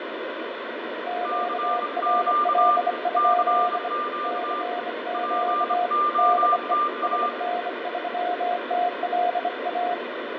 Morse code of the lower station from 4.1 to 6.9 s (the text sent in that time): CQ DE